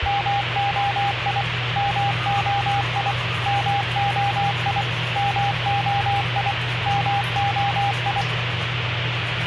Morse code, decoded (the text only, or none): MOI MOI MOI MOI MOI